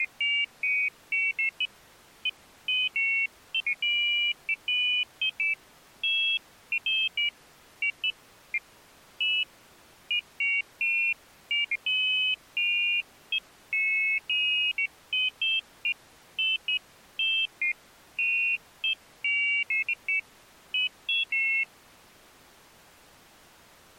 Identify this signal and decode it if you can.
Pairs of high tones at irregular times. There is no code.